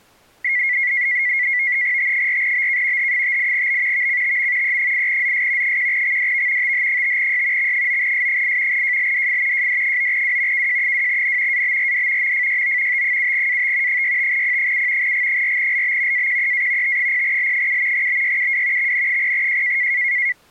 NAVTEX (SITOR-B), 100 baud, 170 Hz shift, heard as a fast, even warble, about 2050 Hz centre. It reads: T4BK H58B VCTM E8ZS 1XDV TH5Y X9S8 JLDF JD9W KJ2N ABRD MFYO T7AT 65P7 G4LB AQEA T0L7 BYUW XN0J